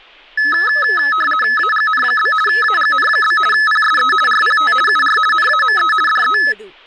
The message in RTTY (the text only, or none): AGN? AGN? PSE RPT UR NAME DE